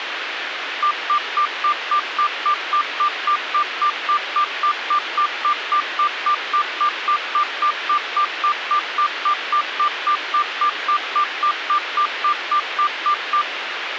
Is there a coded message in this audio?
No, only evenly repeated beeps, with radio hiss.